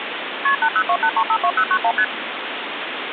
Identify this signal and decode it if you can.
Multi-frequency trunk signalling (R1, as on North American trunks), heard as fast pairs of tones, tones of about 70 ms, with phone line noise. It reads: KP 8028352091 ST